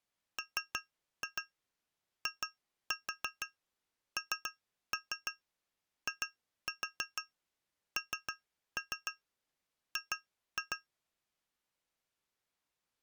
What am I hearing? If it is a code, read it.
Tap code, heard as taps on glass, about 6 knocks a second. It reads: MINING